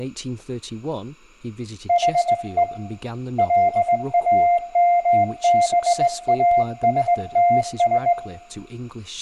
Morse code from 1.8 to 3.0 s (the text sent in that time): HE